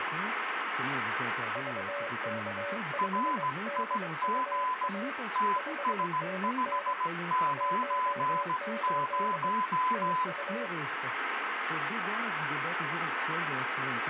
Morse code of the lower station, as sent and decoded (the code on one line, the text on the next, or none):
...- -.- ..... -.. ..- .- / ..... -. -. / .---- ---.. / - ..-
VK5DUA 5NN 18 TU